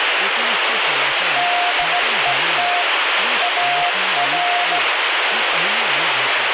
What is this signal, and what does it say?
Morse code, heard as a keyed tone, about 16 wpm, 710 Hz, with heavy radio static and speech in Marathi. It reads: DET AR